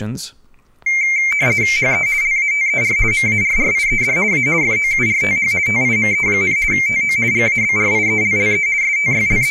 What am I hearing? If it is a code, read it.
RTTY (50 baud, 170 Hz shift), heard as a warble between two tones, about 2200 Hz centre, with speech in English. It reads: HE LATER MARRIED A FOURTH TIME, TO GABRIELLE …